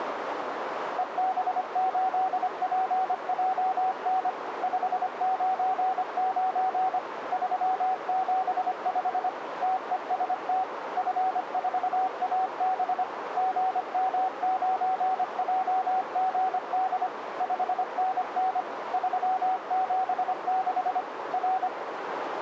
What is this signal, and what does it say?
Morse code, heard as a keyed tone, machine-sent, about 25 wpm, 750 Hz, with radio static and a narrow filter. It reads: EB8PJN 599 375 TEST F4AB GM9JGD 5NN 376 R